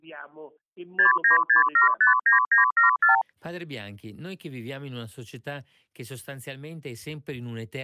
Multi-frequency trunk signalling (R2, with the far end's replies), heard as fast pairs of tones, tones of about 130 ms. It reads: 696759974